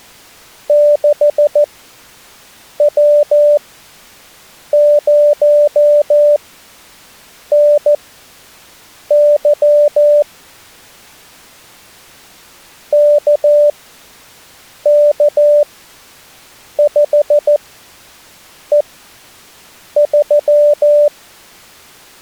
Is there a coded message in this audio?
Yes: Morse code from 0.6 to 21.1 s, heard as a keyed tone, machine-sent, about 14 wpm, spaced as for 6 wpm, 590 Hz. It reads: 6W0NY KK5E3